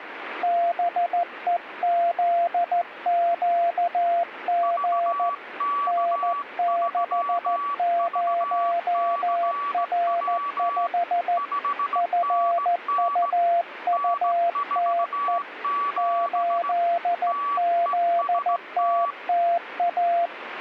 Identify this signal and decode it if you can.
Morse code, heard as two keyed tones, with radio static. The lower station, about 14 wpm, 690 Hz: BEZQG N60R5 FUUTE 8ZTTA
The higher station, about 17 wpm, 1140 Hz: VK3VCW 5NN N47 TEST